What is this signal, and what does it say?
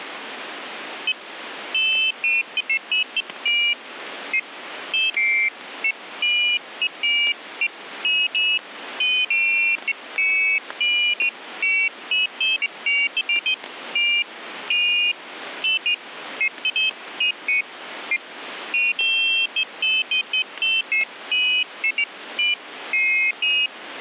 Pairs of high tones at irregular times, with static crashes. There is no code.